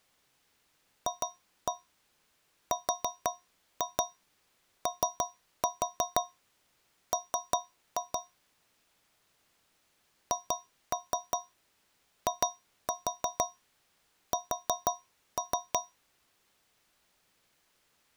Tap code, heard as taps on a metal pipe, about 5 knocks a second. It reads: FROM HIS